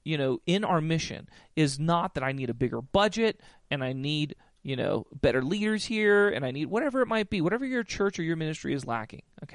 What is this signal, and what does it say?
Speech in English. There is no code.